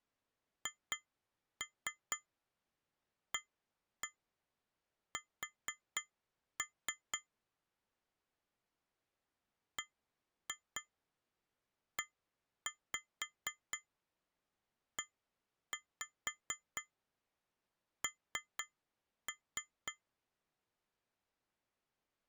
Tap code, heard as taps on glass, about 4 knocks a second. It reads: HAS BEEN